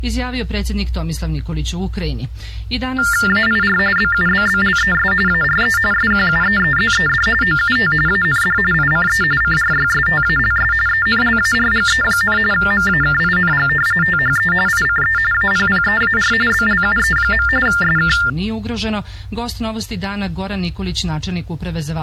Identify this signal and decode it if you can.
TTY/TDD text telephone tones (45.45 baud Baudot), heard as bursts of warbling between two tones, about 400 Hz shift, 1600 Hz centre. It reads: AIR BUBBLES ARE SQUEEZED OUT AND ICE CRYSTALS ENLARGE, MAKING THE ICE APPEAR BLUE. SK